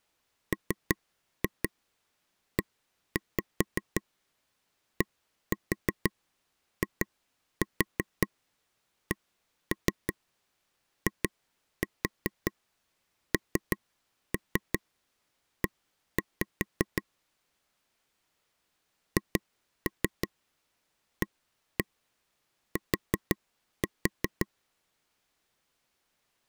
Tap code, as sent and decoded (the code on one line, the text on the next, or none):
3-2 1-5 1-4 2-4 1-3 2-4 3-3 1-5 / 2-3 1-1 4-4
MEDICINE HAT